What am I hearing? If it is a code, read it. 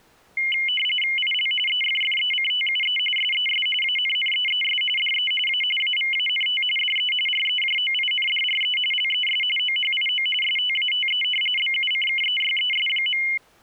RTTY (45.45 baud, 850 Hz shift), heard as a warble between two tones, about 2550 Hz centre. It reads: IL EFFECTUE SES ANNEES DE A AVANT DE REJOINDRE LES OHIO STATE BUCKEYES.